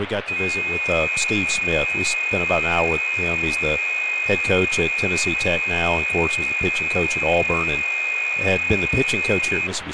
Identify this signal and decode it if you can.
FT8 (several signals at once), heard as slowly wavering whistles, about 6.25 baud, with radio static and speech in English.